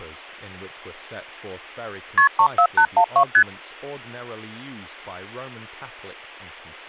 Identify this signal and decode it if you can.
Multi-frequency trunk signalling (R1, as on North American trunks), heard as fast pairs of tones, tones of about 80 ms, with speech in English. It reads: KP 34812 ST